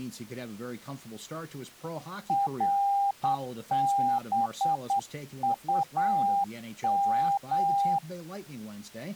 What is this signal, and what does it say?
Morse code, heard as a keyed tone, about 9 wpm, 800 Hz, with speech in English. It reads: RBUM